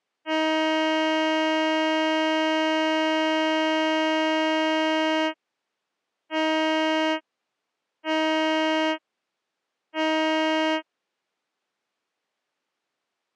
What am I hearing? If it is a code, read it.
Ship horn signal, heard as a ship's horn, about 320 Hz. 1 long, 3 short. At sea: a vessel under tow in fog.